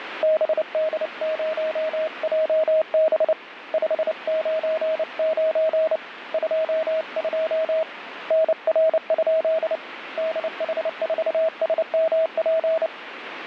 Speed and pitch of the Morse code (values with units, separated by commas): 29 wpm, 640 Hz